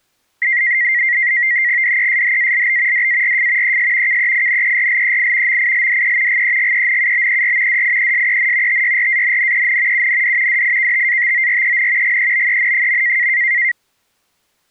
NAVTEX (SITOR-B), 100 baud, 170 Hz shift, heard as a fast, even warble, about 2000 Hz centre. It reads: DESHALB DARF ES KEINERLEI MILDE GEGENUBER DIESEN TYRANNEN UND DIKTATOREN GEBEN.